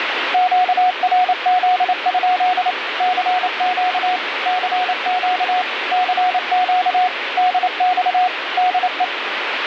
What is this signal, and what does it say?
Morse code, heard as a keyed tone, machine-sent, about 28 wpm, 730 Hz, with radio static. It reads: QRZ? CQ CQ CQ DX DE